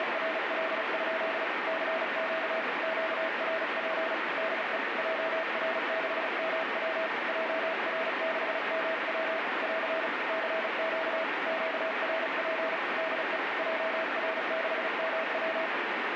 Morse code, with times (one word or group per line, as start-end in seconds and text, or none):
0.0-1.4 …
1.7-2.6 CQ
2.8-4.1 QRP
4.4-4.8 DE
5.0-7.1 JR6MW
7.3-9.4 JR6MW
9.6-10.1 <AR>
10.3-11.2 CQ
11.5-12.8 QRP
13.0-13.4 DE
13.6-15.7 JR6MW